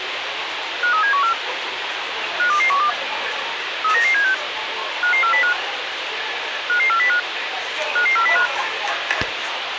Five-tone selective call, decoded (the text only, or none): 53714 52212 39976 55405 55405 55405